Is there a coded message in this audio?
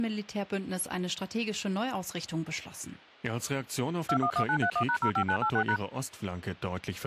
Yes: DTMF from 4.1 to 5.8 s, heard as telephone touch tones, dialled by machine, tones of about 80 ms, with speech in German. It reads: 211931#05986#